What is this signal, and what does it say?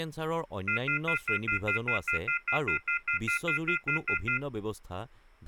Telephone call progress tone (North American plan), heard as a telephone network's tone, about 1400, 2050, 2450, 2600 Hz, 0.1 s on and 0.1 s off, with speech in Assamese. Off-hook warning tone.